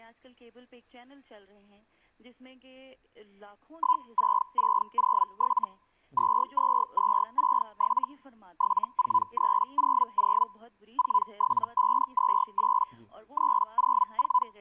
Hellschreiber (Feld-Hell, 122.5 baud), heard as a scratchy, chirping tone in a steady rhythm, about 1000 Hz. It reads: 16607 22267 74300 47528 …